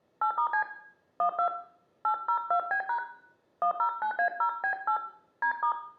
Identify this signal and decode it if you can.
DTMF, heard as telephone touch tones, dialled by hand, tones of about 90 ms, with room echo. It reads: 8*C 12 802B# 109A0B8 D*